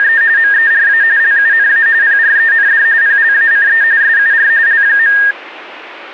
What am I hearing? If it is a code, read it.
RTTY (45.45 baud, 170 Hz shift), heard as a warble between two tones, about 1750 Hz centre. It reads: … MERA LUNA PREND PLACE SUR L.